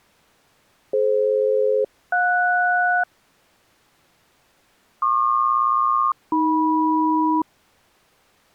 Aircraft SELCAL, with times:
0.9-3.0 DF-JS
5.0-7.4 PQ-AM

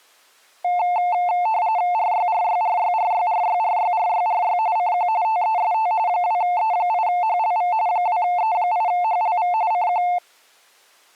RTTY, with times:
1.9-4.6 RYRYRYRYRYRYRYRY
4.8-5.1 CQ
5.2-5.9 TEST
6.1-7.7 2E8HLV
7.9-9.5 2E8HLV
9.7-10.0 CQ

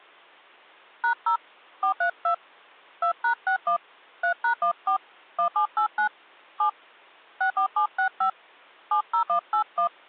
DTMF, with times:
1.0-1.4 #0
1.8-2.3 432
3.0-3.8 2#61
4.2-5.0 3#14
5.4-6.1 1789
6.6-6.7 7
7.4-8.3 64765
8.9-9.9 70181

